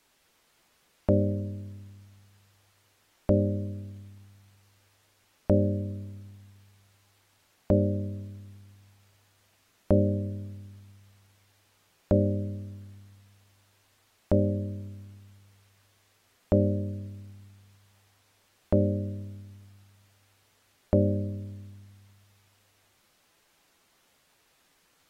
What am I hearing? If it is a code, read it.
Clock strike, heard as a bell. 10. Ten o'clock.